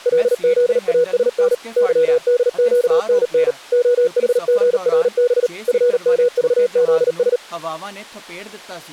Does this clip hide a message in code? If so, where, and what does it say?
Yes: Morse code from 0.0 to 7.4 s, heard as a keyed tone, machine-sent, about 38 wpm, 490 Hz, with speech in Punjabi. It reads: LZASN YDQNN OHGRB FMVZS